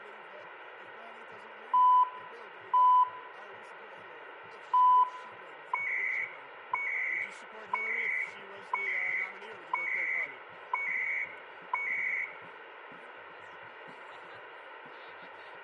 Radio time signal (CHU, Canada), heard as beeps and data bursts, one a second, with radio static and room echo.